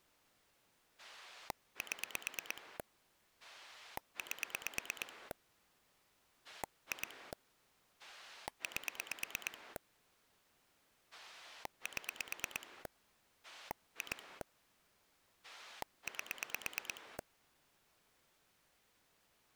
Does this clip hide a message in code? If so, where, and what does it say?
Yes: pulse dialling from 1.0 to 17.2 s, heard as a rotary dial, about 8 pulses a second. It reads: 7 8 2 8 7 2 8